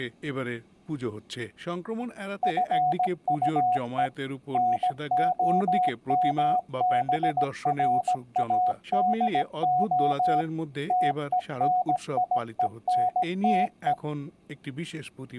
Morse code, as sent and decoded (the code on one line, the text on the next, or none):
..-. ..- . / -. --- -- -... .-. .- -.. --- / - . -. .. . -. - .
FUE NOMBRADO TENIENTE